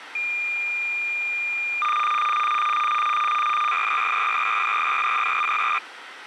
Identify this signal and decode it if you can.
Cassette data (Kansas City type), 300 baud, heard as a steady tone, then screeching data.